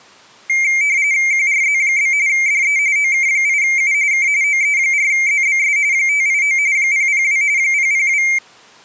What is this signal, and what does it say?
RTTY (45.45 baud, 170 Hz shift), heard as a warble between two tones, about 2200 Hz centre. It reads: QRZ? DE OK8U K OE4ZBS 589 002 002